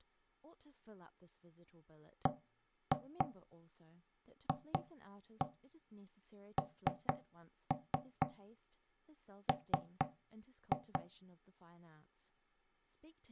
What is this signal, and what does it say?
Tap code, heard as knocks on wood, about 4 knocks a second, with speech in English. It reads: BFNM